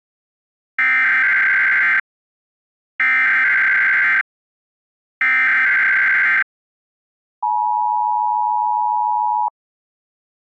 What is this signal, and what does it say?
Emergency Alert System (SAME) tones (header bursts, then the 853 and 960 Hz attention tone), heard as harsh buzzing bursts, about 520.83 baud.